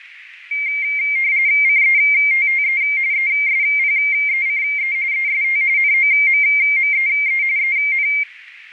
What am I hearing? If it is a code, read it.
RTTY (45.45 baud, 170 Hz shift), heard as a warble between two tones, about 2200 Hz centre, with radio static. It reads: CETTE ESPECE EST NOMMEE EN